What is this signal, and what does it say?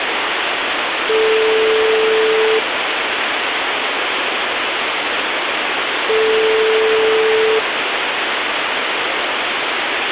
Telephone call progress tone (single-tone plan, as in most of Europe), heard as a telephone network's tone, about 440 Hz, 1.5 s on and 3.5 s off, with phone line noise. Ringback tone.